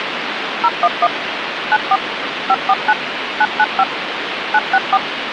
DTMF, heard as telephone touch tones, dialled by machine, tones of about 50 ms, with phone line noise. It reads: 011 94 549 995 964